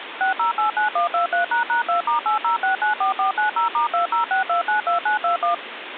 DTMF, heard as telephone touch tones, dialled by machine, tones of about 120 ms, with phone line noise. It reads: 6089123##2*80694490*206292921